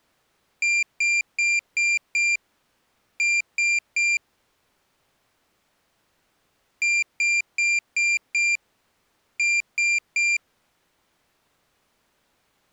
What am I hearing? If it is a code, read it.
Beep code, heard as a piezo beeper, played twice, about 2400 Hz. 5-3.